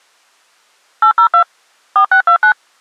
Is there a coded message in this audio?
Yes: DTMF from 1.0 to 2.5 s, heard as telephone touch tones, dialled by machine, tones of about 90 ms. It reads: 802 4629